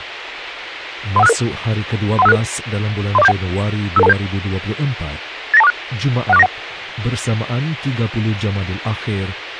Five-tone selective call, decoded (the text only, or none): 31566 31566 30471 55227 89246 16491